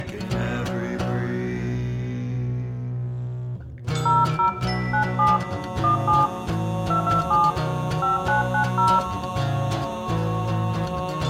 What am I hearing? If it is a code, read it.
DTMF, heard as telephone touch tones, dialled by hand, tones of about 170 ms, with room echo. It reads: 00 97 17 227 5990